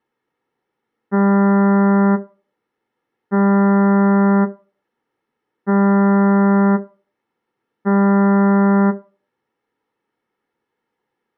Ship horn signal, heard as a ship's horn, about 200 Hz. 4 short. At sea: a pilot vessel's identity signal in fog.